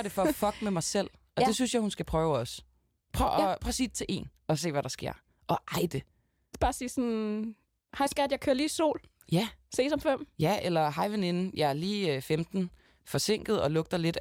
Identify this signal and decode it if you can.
Speech in Danish. There is no code.